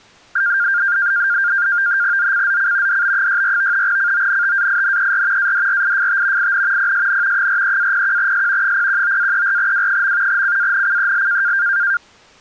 NAVTEX (SITOR-B), 100 baud, 170 Hz shift, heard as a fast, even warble, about 1500 Hz centre. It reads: ZCZC DB64 CONTAINER ADRIFT IN PSN 43-01S 019-34W. CANCEL